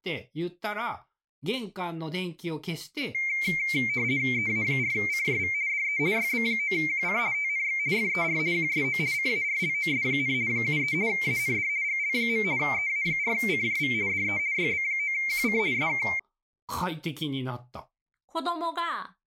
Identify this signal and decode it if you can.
RTTY (50 baud, 170 Hz shift), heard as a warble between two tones, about 2200 Hz centre, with speech in Japanese. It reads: EA4CJV DE YB9QC TNX FER QSO CARLOS, 73 AND GL. EA4CJV DE YB9QC SK